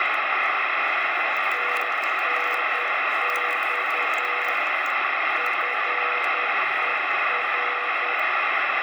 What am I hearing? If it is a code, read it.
Morse code, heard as a keyed tone, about 10 wpm, 490 Hz, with heavy radio static and the noise inside a lift. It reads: TNX FER